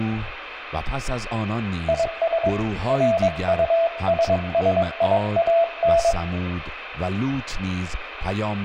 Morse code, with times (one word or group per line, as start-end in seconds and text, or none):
1.9-2.5 IS
2.9-6.1 RUSSIAN